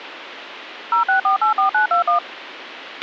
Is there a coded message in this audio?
Yes: DTMF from 0.9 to 2.2 s, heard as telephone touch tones, dialled by machine, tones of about 120 ms, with radio hiss and a squelch burst at the end. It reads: 06484921